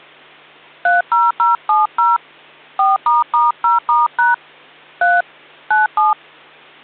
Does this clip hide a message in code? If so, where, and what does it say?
Yes: DTMF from 0.9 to 6.1 s, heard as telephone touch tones, dialled by hand, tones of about 170 ms. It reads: 30070 4**0*# 3 97